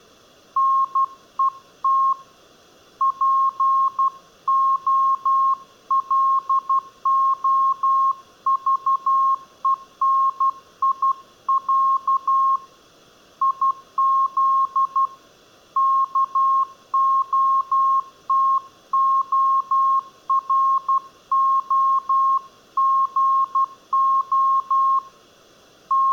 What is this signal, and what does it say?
Morse code (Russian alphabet), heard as a keyed tone, hand-sent with a paddle, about 12 wpm, 1080 Hz. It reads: НЕТ ПОЛОЖЕНИЯ ИЗ КОТОРОГО …